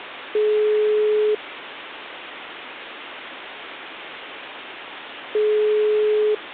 Telephone call progress tone (single-tone plan, as in most of Europe), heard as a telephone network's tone, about 420 Hz, 1 s on and 4 s off. Ringback tone.